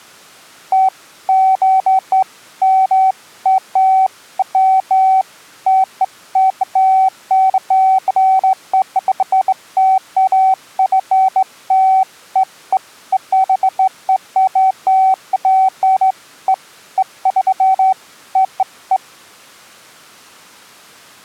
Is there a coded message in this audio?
No, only beeps of irregular length.